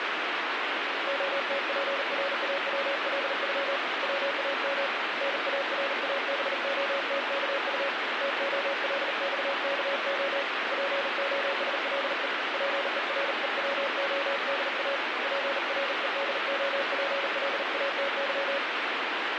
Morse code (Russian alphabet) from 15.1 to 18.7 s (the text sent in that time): ПРЕДОПЛАТЫ